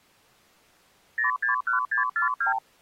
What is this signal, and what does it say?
Multi-frequency trunk signalling (R2, with the far end's replies), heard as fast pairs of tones, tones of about 120 ms. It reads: 061642